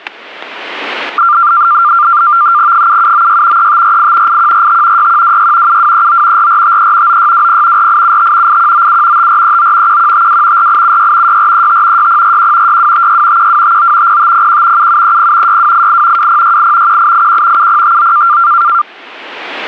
NAVTEX (SITOR-B), 100 baud, 170 Hz shift, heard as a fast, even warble, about 1280 Hz centre, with static crashes. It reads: 7796 3548 8145 6126 7239 4453 9620 4875 8197 5439 1152 4876 6435 6041 6256 1259 0501 7730 6288 2068 1881 7059